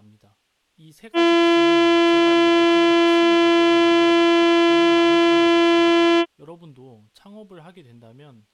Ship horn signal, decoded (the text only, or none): 1 long